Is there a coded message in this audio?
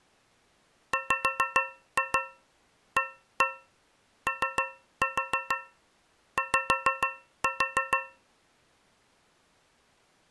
Yes: tap code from 0.9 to 8.3 s, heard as taps on a metal pipe, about 6 knocks a second. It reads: WAOY